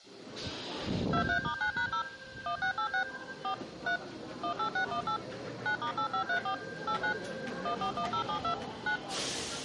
DTMF, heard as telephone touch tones, dialled by machine, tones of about 90 ms, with the noise of a subway station. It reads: 23*9#0 1686 4 3 18618 9*8534 89 141072 9